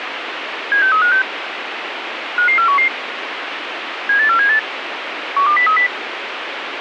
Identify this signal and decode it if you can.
Five-tone selective call (CCIR), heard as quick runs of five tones, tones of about 100 ms, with radio hiss. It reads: 76356 55411 78478 12030